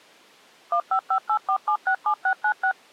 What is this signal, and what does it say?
DTMF, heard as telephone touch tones, dialled by machine, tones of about 80 ms. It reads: 15584767696